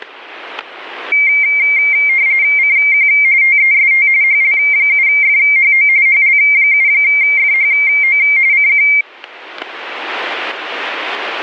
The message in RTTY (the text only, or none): CQ TEST HL7FHO HL7FHO CQ